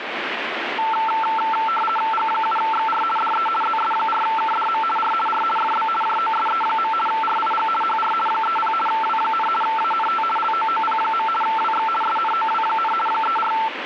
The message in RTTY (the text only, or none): G7XR DE ZS4KDM R R FB JOSE. RIG HR 30 W, ANT LOOP. WX SNOW, 34